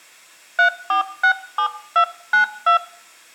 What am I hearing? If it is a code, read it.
DTMF, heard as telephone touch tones, dialled by hand, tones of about 100 ms, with room echo. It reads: 3467292